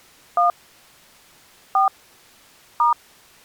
DTMF, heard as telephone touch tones, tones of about 130 ms. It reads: 1 4 *